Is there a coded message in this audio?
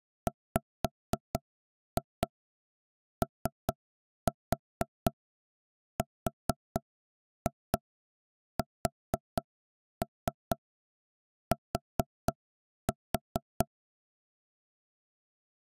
Yes: tap code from 0.3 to 13.7 s, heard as knocks on wood, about 4 knocks a second. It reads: WORST